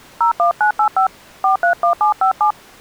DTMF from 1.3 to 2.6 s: 431757

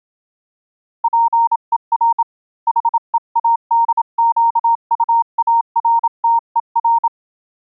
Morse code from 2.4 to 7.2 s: HEADQUARTER

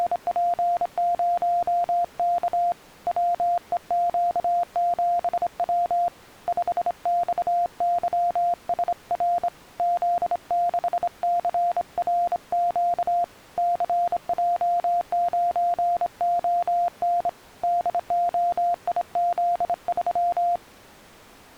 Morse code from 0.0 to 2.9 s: …

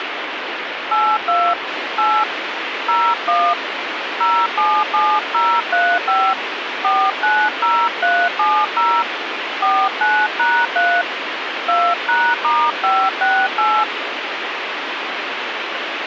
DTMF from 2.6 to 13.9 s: 01 077035 490370 49#3 2#*568

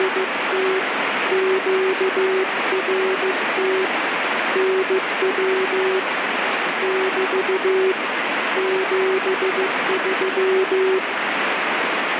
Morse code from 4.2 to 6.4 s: NW

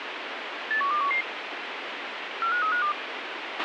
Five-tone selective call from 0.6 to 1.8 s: 81211

